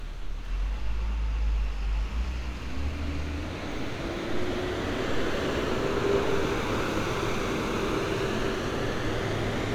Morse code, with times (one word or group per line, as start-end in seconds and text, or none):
none